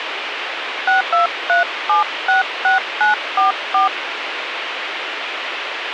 DTMF, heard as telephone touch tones, dialled by hand, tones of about 130 ms, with radio hiss. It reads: 623766944